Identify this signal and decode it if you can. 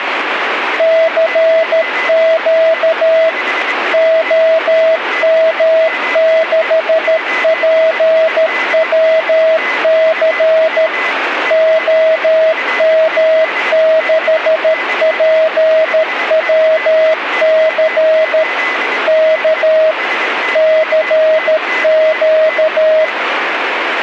Morse code, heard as a keyed tone, machine-sent, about 13 wpm, 640 Hz, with radio static and a weaker station near 2010 Hz. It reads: CQ OM6PWC OM6PWC K CQ